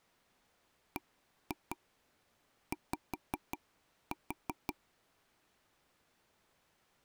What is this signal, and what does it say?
Tap code, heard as taps on a table, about 5 knocks a second. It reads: BY